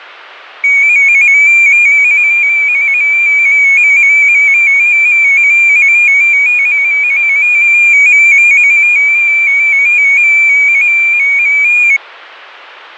Multi-tone FSK (Olivia or MFSK type), about 250 Hz wide, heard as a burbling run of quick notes, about 15.625 baud.